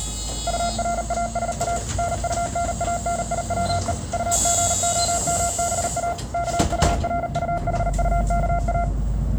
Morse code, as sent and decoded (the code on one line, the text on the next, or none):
..- .-. .- ... .- / -. ..- -. .- -. .. .-- . / ..- --. --- -- -... .- / -.- ..- .-. ..- .... ..- -.- .-
URASA NUNANIWE UGOMBA KURUHUKA